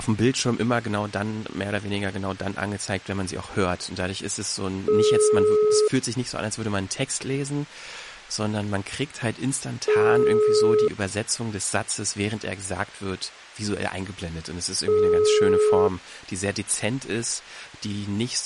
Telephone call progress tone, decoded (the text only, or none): ringback tone